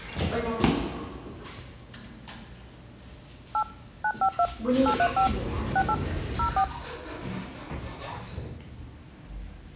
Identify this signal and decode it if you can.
DTMF, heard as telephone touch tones, dialled by hand, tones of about 80 ms, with the noise inside a lift. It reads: 8 952 835 68 04